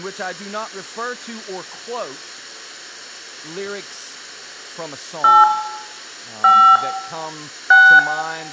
DTMF, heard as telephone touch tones, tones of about 270 ms, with room echo. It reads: 8 5 6